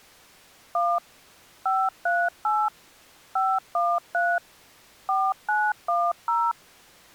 DTMF, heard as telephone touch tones, dialled by machine, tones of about 240 ms. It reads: 1 538 513 4910